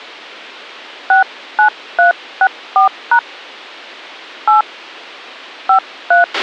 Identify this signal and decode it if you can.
DTMF, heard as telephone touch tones, dialled by hand, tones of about 100 ms, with a squelch burst at the end. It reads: 69364# 8 53